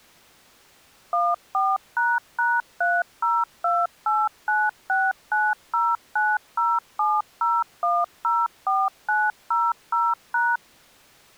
DTMF, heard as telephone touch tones, dialled by machine, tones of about 220 ms. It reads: 14##302896909070104900#